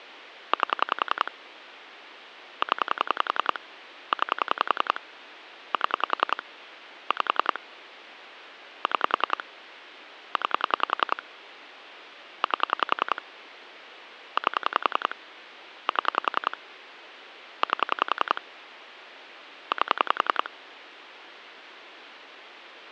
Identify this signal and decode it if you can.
Pulse dialling, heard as clicks on a phone line, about 10 pulses a second. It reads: 8 0 9 7 5 6 9 8 8 7 8 8